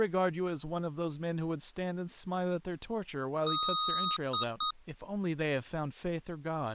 Beep code, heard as beeps from a small speaker, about 1250 Hz, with speech in English. 1 long, 2 short. In Award, IBM and AMI BIOS tables: video adapter failure.